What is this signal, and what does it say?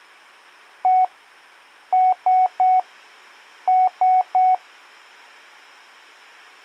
Beep code, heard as beeps, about 740 Hz. 1-3-3. In Phoenix BIOS tables: chip or data line failure in the first 64 KB of memory.